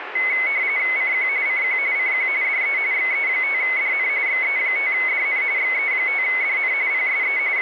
RTTY (45.45 baud, 170 Hz shift), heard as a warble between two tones, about 2150 Hz centre, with radio static. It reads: CQ CQ CQ DE XE5DN XE5DN XE5DN PSE …